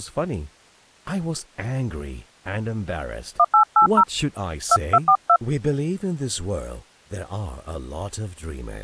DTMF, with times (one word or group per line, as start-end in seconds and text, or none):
3.4-4.0 1880
4.7-5.4 2242